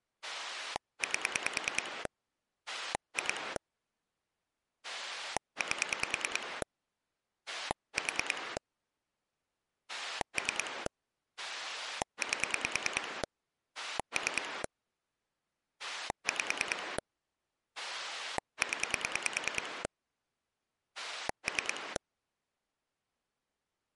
Pulse dialling, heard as a rotary dial, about 9 pulses a second. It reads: 8 2 8 4 3 8 3 5 0 3